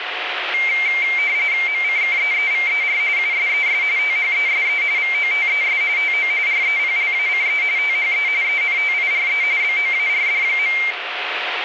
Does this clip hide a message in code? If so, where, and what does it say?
Yes: RTTY (45.45 baud, 170 Hz shift) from 0.5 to 10.9 s, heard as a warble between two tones, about 2200 Hz centre, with radio static. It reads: MCKEEVER USES THESE VOTES TO REPLACE THE ENTIRE BOARD.